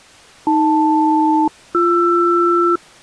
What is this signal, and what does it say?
Aircraft SELCAL, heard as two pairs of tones. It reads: AL-BR